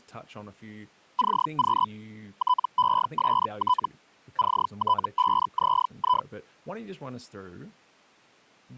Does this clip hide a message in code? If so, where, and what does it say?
Yes: Hellschreiber (Feld-Hell, 122.5 baud) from 1.2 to 6.3 s, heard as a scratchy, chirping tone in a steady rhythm, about 1000 Hz, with speech in English. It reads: CQ TEST CT5ZI